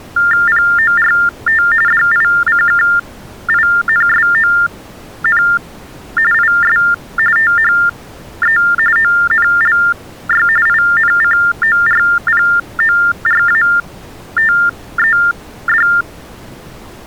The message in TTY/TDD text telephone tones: PORT DICKINSON IS THE ONLY INCORPORATED

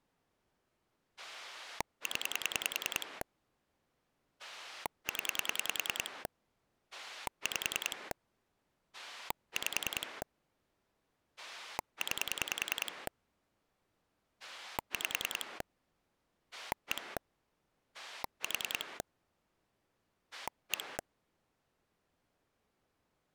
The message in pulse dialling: 0 0 5 5 9 5 1 4 1

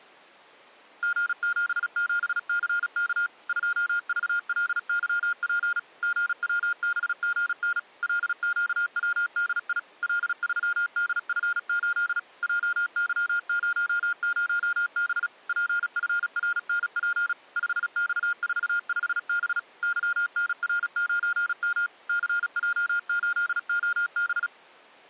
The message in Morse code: G77CK 2VLYP GWBGN LQWDI L3DF8 JY00B PFRNP 5X45B YNR9M CJ8OB

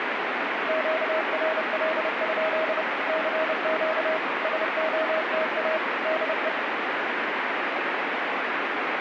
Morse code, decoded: QRL? CQ SOTA DE

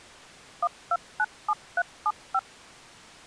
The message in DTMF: 1297375

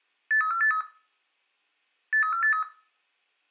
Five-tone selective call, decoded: 83483 83483

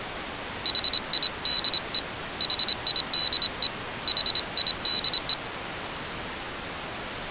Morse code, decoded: HIDE HIDE HIDE

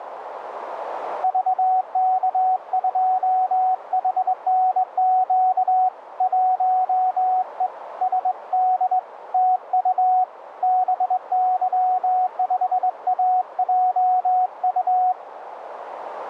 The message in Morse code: VK2HNQ 1E SD TU BY5AJU

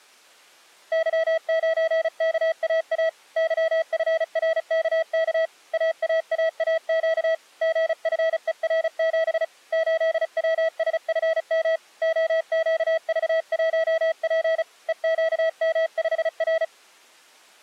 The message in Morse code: Y9KAA YFRKK AAAAQ GFER7 8WSFM OQV1P EQM5R

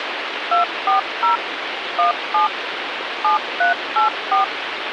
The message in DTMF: 240 17 7384

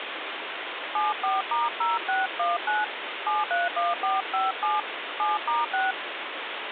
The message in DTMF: 74*0619 731457 7*6

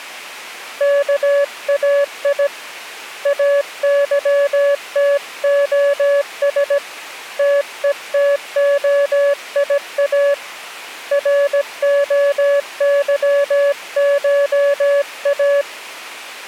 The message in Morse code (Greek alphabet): ΚΑΙ ΑΥΤΟΣ ΤΕΤΟΙΑ ΡΟΥΧΑ

